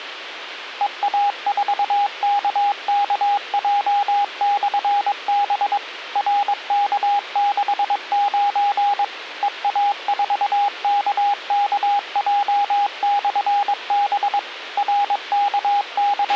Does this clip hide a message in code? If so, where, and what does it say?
Yes: Morse code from 0.7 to 16.4 s, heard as a keyed tone, machine-sent, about 22 wpm, 810 Hz, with radio hiss and a squelch burst at the end. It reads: EA4KKJ/B RK69 EA4KKJ/B …